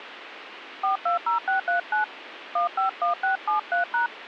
DTMF, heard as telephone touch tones, dialled by hand, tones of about 120 ms, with radio hiss. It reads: 420639 151673#